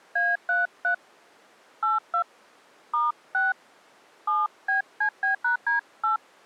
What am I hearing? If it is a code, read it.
DTMF, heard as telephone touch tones, dialled by hand, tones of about 160 ms. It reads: A33 82 *6 7BCB#D8